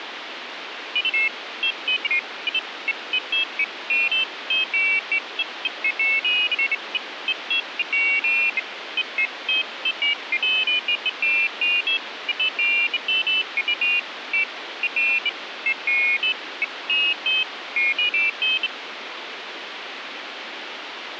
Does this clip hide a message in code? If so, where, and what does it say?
No, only pairs of high tones at irregular times, with radio hiss.